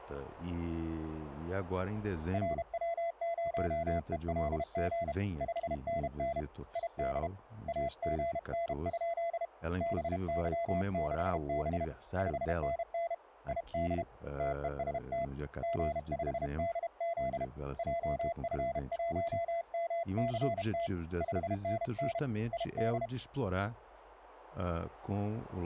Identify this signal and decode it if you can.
Morse code, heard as a keyed tone, hand-sent with a paddle, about 32 wpm, 680 Hz, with speech in Russian. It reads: RW0ELG 5NN ID AGN? BY6B 5NN ID TEST G5DZ JF1MCT 5NN ID